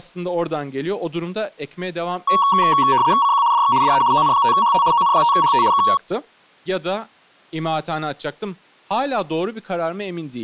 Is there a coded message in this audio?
Yes: RTTY (75 baud, 170 Hz shift) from 2.3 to 6.0 s, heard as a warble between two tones, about 1030 Hz centre, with speech in Turkish. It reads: CQ DX DE ON5HT ON5HT K